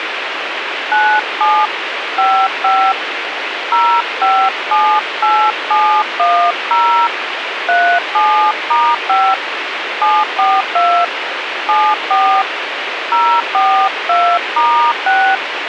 DTMF, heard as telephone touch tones, dialled by hand, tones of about 290 ms, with radio hiss. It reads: 97 55 0578710 37*5 742 74 042*6